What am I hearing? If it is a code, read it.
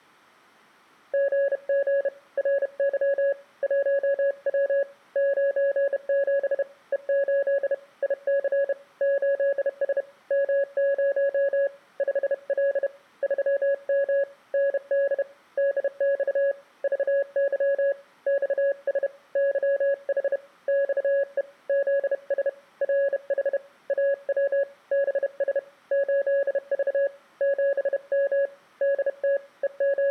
Morse code, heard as a keyed tone, hand-sent with a bug key, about 31 wpm, 560 Hz. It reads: GG RY 1W 97 E8 IC 8S M0 5L 3M ND DX VY XS YH XE ZS RH AW BS 8V 7M DT …